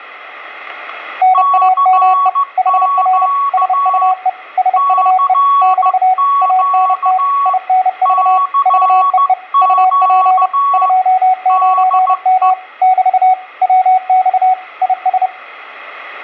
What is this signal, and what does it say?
Morse code, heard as two keyed tones, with room echo. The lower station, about 30 wpm, 740 Hz: NAME HR SUE SUE <BT> ANT INV VEE UP 29M <BT> WX IS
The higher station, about 15 wpm, 1120 Hz: CQ CQ CQ DE